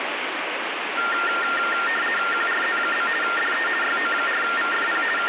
RTTY (50 baud, 450 Hz shift), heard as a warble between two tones, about 1600 Hz centre, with radio static. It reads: QRZ? DE YO4VFP …